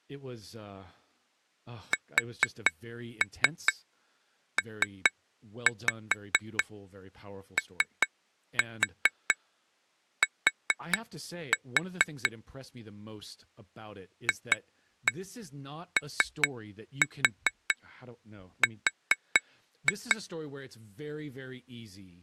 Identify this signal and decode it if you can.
Tap code, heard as taps on glass, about 4 knocks a second, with speech in English. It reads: SPOT FOR